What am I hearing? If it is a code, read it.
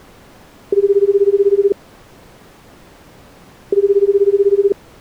Telephone call progress tone (Japanese plan), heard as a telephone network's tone, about 380, 400, 420 Hz, 1 s on and 2 s off. Ringback tone.